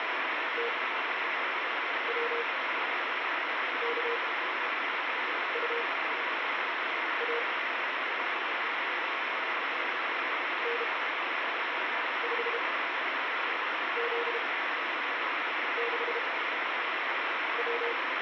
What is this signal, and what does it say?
Morse code, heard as a keyed tone, machine-sent, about 32 wpm, spaced as for 6 wpm, 470 Hz, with heavy radio static. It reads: TWKUA N5Z6W